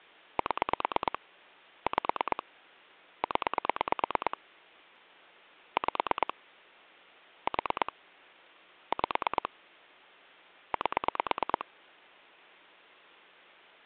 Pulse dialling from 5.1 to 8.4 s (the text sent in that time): 5 4